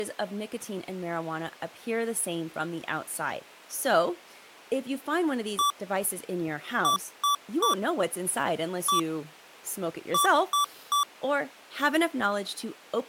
Beep code, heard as beeps from a small speaker, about 1160 Hz, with speech in English. 1-3-1-3. In Phoenix BIOS tables: keyboard controller test failure.